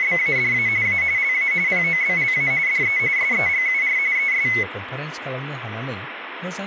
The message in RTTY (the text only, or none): … A LA POBLA DE SEGUR ES